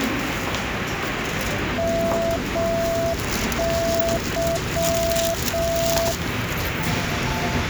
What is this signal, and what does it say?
Morse code, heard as a keyed tone, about 6 wpm, 670 Hz, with radio static and the noise of a subway station. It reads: MY